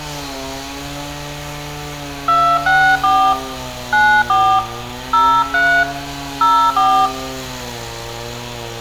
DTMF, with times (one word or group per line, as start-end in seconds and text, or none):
2.3-3.3 264
3.9-4.6 94
5.1-5.8 03
6.4-7.1 04